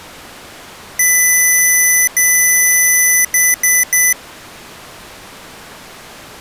Beep code, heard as beeps from a small speaker, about 2000 Hz. 2 long, 3 short.